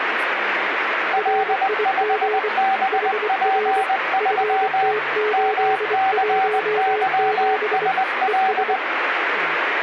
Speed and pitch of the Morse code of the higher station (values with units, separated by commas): 20 wpm, 770 Hz